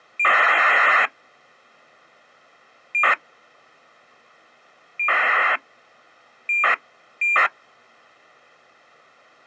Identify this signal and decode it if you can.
ACARS aircraft data, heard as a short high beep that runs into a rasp, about 2400 baud.